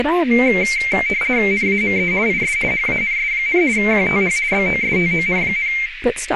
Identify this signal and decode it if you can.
RTTY (50 baud, 170 Hz shift), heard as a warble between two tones, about 2200 Hz centre, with radio static, a narrow filter and speech in English. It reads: NAME IS HANS, QTH BOSTON,